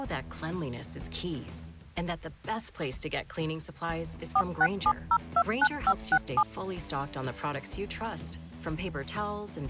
DTMF, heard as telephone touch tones, dialled by machine, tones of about 60 ms. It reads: 467029567